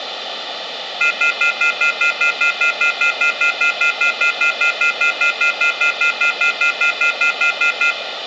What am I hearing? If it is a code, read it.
Telephone call progress tone (North American plan), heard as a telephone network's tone, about 1400, 2050, 2450, 2600 Hz, 0.1 s on and 0.1 s off, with phone line noise and room echo. Off-hook warning tone.